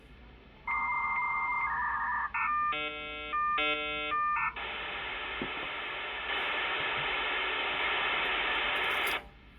Dial-up modem handshake (V.34 or later), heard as a whistle, warbles, then hiss, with the noise of a restaurant.